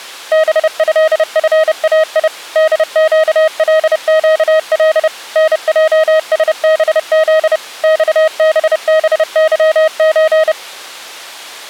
Morse code (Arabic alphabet), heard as a keyed tone, machine-sent, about 30 wpm, 630 Hz. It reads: بهفاي دقلقل نجسبذ صببظز